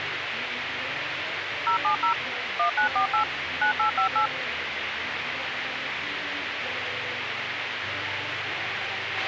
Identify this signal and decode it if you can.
DTMF, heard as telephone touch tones, dialled by machine, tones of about 110 ms, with radio hiss and a squelch burst at the end. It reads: 070 1948 9858